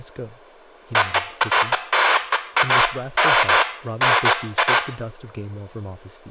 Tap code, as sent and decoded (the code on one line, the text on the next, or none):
none